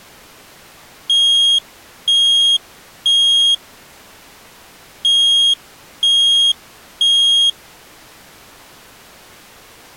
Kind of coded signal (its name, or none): alarm pattern